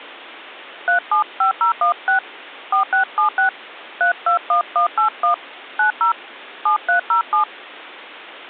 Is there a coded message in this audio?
Yes: DTMF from 0.9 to 7.4 s, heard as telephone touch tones, dialled by hand, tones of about 110 ms. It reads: 375016 4676 321181 90 7307